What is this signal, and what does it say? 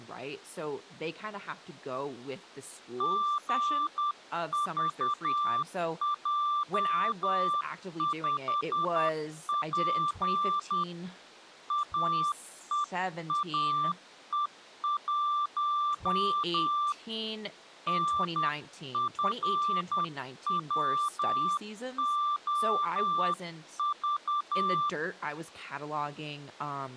Morse code, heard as a keyed tone, hand-sent with a paddle, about 10 wpm, 1180 Hz, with speech in English. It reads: GVJ5P AEAE1 NFWOV